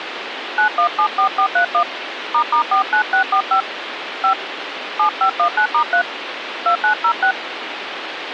DTMF, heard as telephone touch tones, dialled by hand, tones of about 90 ms, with phone line noise. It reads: 9174431 **49645 5 7519*3 2906